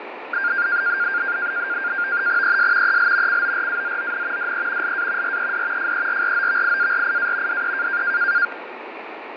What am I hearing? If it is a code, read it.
NAVTEX (SITOR-B), 100 baud, 170 Hz shift, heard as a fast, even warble, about 1500 Hz centre, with radio static and fading. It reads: ES EL CORAZON DE LA RED FERROVIARIA DE